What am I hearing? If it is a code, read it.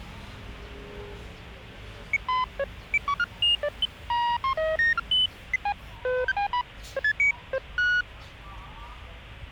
Electronic bleeps of random pitch and length, with street noise. There is no code.